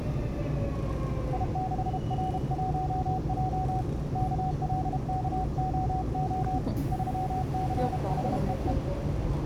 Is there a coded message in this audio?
Yes: Morse code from 1.3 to 8.8 s, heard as a keyed tone, hand-sent with a paddle, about 32 wpm, 750 Hz, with the noise inside a subway train. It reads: I6R1J KLKOO 36HEE